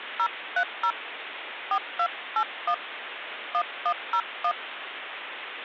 DTMF, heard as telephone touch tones, dialled by hand, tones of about 70 ms, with phone line noise. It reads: 030 4281 1101